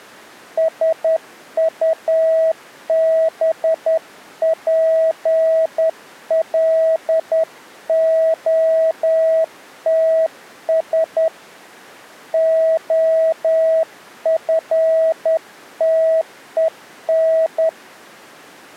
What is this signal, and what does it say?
Morse code, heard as a keyed tone, hand-sent with a straight key, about 10 wpm, 650 Hz. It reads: SUBPLOTS OFTEN